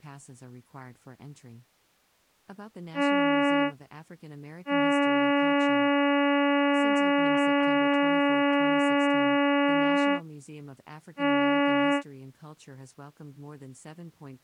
Ship horn signal, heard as a ship's horn, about 280 Hz, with speech in English. 1 short, 1 long, 1 short. At sea: a vessel at anchor warns of its position.